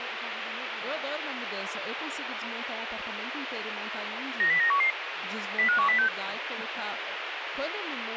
Five-tone selective call (CCIR), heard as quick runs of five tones, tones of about 100 ms, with radio hiss and speech in Portuguese. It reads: 90911 05106